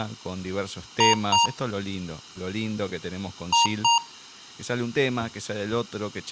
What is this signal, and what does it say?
Beep code, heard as beeps from a small speaker, played twice, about 940 Hz, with room echo and speech in Spanish. 2 short. In AMI BIOS tables: memory parity error; in IBM BIOS tables: self-test error shown on screen; in Dell tables: no memory detected.